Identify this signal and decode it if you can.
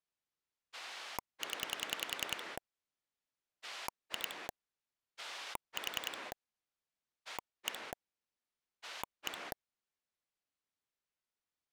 Pulse dialling, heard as a rotary dial, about 10 pulses a second. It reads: 0 2 4 1 1